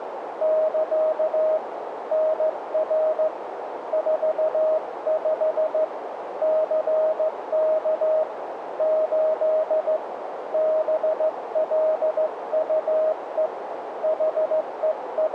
Morse code, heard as a keyed tone, hand-sent with a straight key, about 15 wpm, 630 Hz, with radio static and a narrow filter. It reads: <KA> NR 45 CK 8 BLUE …